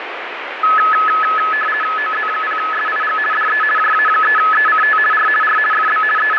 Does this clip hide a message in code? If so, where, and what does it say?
Yes: RTTY (50 baud, 450 Hz shift) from 0.6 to 6.4 s, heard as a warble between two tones, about 1500 Hz centre, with radio static. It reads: OZ0SIG DE JA3ECT R R FB …